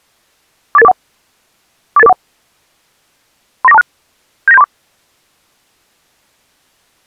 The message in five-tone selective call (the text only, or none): 48841 48841 39426 79734